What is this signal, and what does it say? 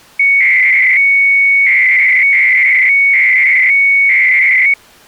300-baud modem data (Bell 103 tones), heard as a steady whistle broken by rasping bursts, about 300 baud, 200 Hz shift.